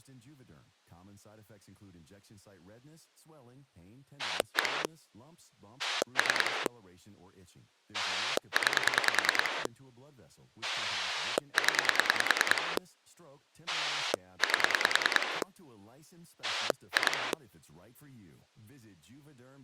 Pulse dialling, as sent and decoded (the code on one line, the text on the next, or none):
1 / 3 / 9 / 10 / 8 / 2
1 3 9 0 8 2